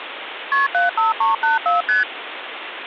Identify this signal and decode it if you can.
Multi-frequency trunk signalling (R1, as on North American trunks), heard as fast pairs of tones, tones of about 150 ms, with phone line noise. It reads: KP 75384 ST